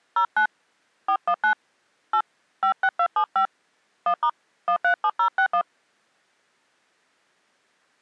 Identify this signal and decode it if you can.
DTMF, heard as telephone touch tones, dialled by hand, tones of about 80 ms. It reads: 09 419 8 56275 1* 137061